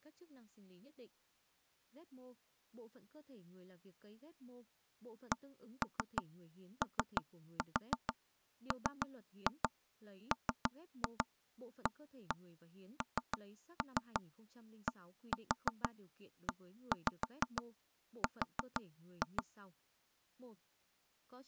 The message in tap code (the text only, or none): COMMANDER